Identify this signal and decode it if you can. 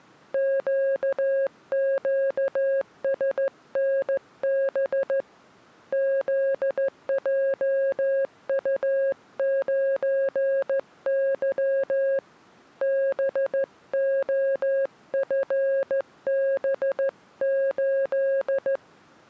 Morse code, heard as a keyed tone, hand-sent with a straight key, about 14 wpm, 540 Hz. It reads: QQSNB ZJU9Y BOFB8